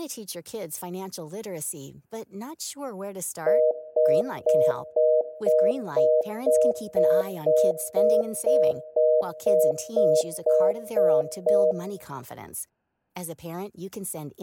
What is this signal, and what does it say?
Telephone call progress tone (North American plan), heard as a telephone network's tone, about 480, 620 Hz, 0.25 s on and 0.25 s off, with speech in English. Congestion tone.